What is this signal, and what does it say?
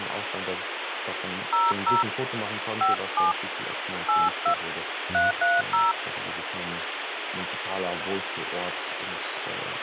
DTMF, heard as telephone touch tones, dialled by hand, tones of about 160 ms, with phone line noise. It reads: 00 57 82 330